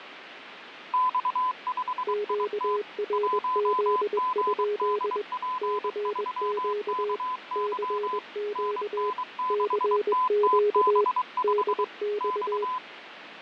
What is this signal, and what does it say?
Morse code, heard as two keyed tones, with radio static and fading. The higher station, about 23 wpm, 1010 Hz: X5IT 1GDP3KY NN6TTB5 X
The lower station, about 21 wpm, 420 Hz: QRZ? CQ CQ CQ DX